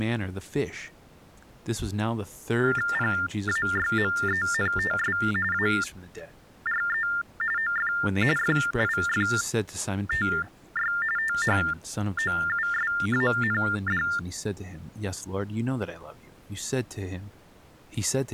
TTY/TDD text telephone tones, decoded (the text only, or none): PAYMENTS ARE OF FIFTY THOUSAND